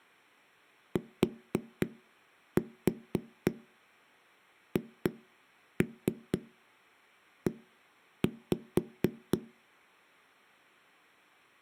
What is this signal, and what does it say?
Tap code, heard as knocks on a wall, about 4 knocks a second. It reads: THE